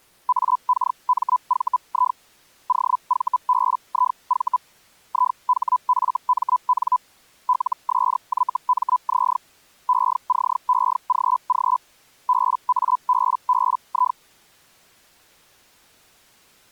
Hellschreiber (Feld-Hell, 122.5 baud), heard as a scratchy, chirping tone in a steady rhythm, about 1000 Hz. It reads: AKMVI OVBIV IHFMN LSYMZ ECEGG BABBI